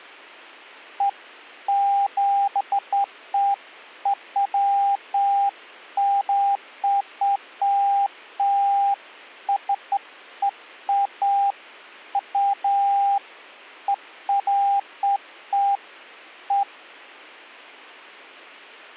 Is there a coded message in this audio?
No, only beeps of irregular length.